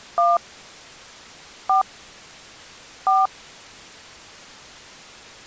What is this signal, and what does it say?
DTMF, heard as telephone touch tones, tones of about 150 ms. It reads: 1 4 4